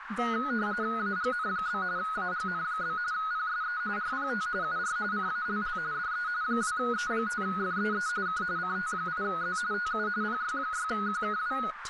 RTTY (45.45 baud, 170 Hz shift), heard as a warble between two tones, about 1360 Hz centre, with radio static, a narrow filter and speech in English. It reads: AGN? AGN? PSE RPT UR CALL DE 2E5FEE K CT8Z TU PY6QKW